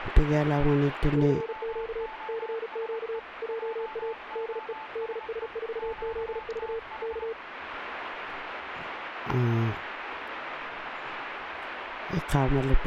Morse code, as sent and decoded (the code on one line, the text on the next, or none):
-.-. --.- / -.-. --.- / .--- .- / -.. . / -.. ... ....- --.. ...- / -.-
CQ CQ JA DE DS4ZV K